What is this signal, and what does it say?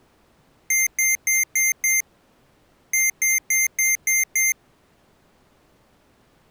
Beep code, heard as beeps from a small speaker, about 2100 Hz. 5-6.